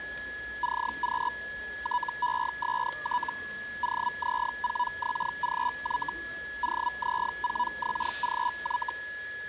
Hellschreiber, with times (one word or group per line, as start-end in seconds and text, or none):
0.6-1.3 CQ
1.8-3.3 TEST
3.8-6.1 OZ4XGY
6.6-8.9 OZ4XGY